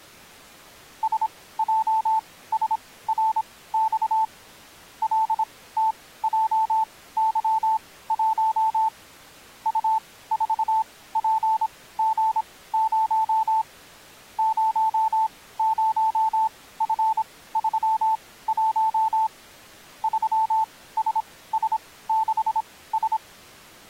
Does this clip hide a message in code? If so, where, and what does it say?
Yes: Morse code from 1.0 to 23.2 s, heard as a keyed tone, machine-sent, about 26 wpm, spaced as for 17 wpm, 880 Hz. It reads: SJSRX LTJY1 U4PG0 00F31 3SS6S